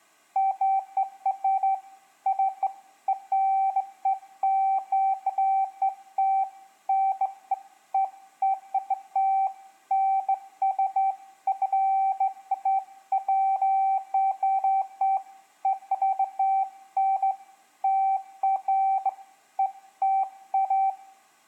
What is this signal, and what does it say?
Beeps of irregular length, with room echo. There is no code.